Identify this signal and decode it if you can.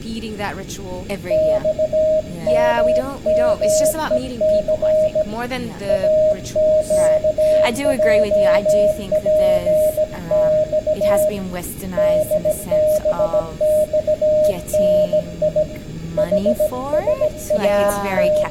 Morse code, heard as a keyed tone, hand-sent with a bug key, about 17 wpm, 620 Hz, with room echo and speech in English. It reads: XMMEC AQJPX DBXNI …